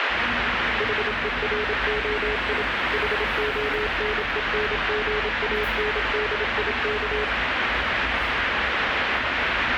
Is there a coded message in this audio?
Yes: Morse code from 0.7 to 7.3 s, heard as a keyed tone, machine-sent, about 27 wpm, 420 Hz, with radio static and street noise. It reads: HEROI HONENGANDIK